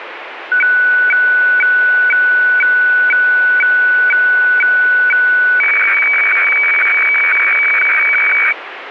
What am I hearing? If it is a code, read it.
Weather fax (radiofax), 120 lines a minute, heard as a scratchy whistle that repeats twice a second, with radio static.